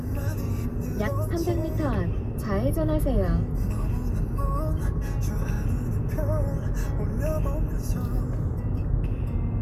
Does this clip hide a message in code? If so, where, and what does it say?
No, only the noise inside a car.